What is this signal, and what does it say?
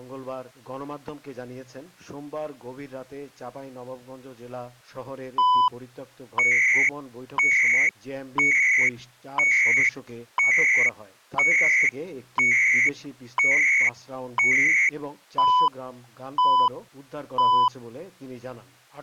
Radio time signal (CHU, Canada), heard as beeps and data bursts, one a second.